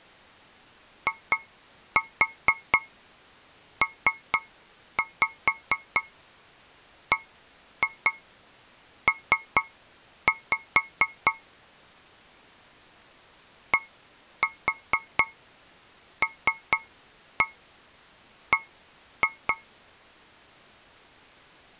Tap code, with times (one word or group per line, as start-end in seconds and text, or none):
1.1-11.3 IPBP
13.7-19.5 DLB